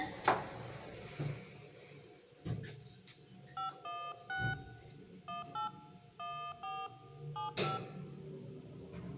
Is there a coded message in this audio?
Yes: DTMF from 3.6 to 7.8 s, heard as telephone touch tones, dialled by hand, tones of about 230 ms, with room echo and the noise inside a lift. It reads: 516 18 14 75